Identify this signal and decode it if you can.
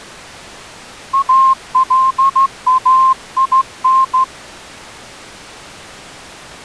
Morse code, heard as a whistle, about 14 wpm. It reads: ALAIN